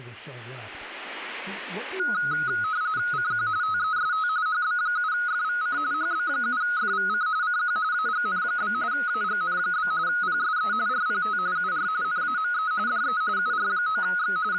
RTTY (45.45 baud, 170 Hz shift), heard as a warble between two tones, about 1360 Hz centre, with speech in English. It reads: CQ TEST HB7FVC HB7FVC CQ AGN? AGN? PSE RPT UR NAME DE UR9X …